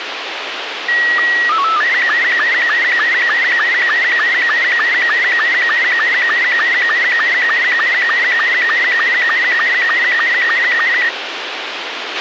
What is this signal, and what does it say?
SSTV (slow-scan television), Robot 72, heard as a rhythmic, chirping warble, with radio hiss and a squelch burst at the end.